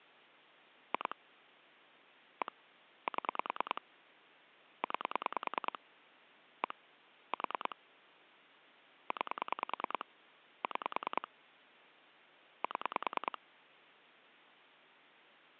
Pulse dialling, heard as clicks on a phone line, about 10 pulses a second. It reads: 2 1 7 9 1 4 9 6 7